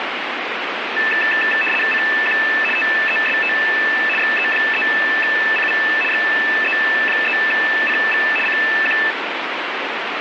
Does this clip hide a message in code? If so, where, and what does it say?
Yes: RTTY (75 baud, 850 Hz shift) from 1.0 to 9.1 s, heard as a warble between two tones, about 2200 Hz centre, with radio static. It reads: CQ TEST XE3CV XE3CV CQ